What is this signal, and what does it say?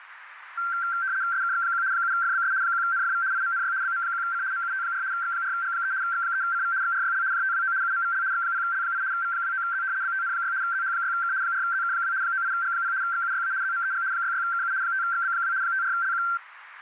RTTY (75 baud, 170 Hz shift), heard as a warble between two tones, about 1460 Hz centre, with radio static and a narrow filter. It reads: SKX1 7FBS 1NFV IMNY BM1C MUT4 X4G3 X3CV XRYL JTWO UMVL X0L8 V29Z BTN6 ZH6K 4ZK2 98G0 XUYA ZMEG 66KU 5XB2 54LQ